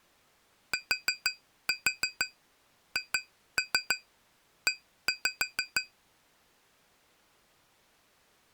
Tap code, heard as taps on glass, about 6 knocks a second. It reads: THE